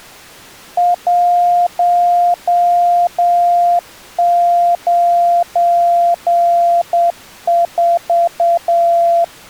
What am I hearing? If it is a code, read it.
Morse code, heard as a keyed tone, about 8 wpm, 690 Hz. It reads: 194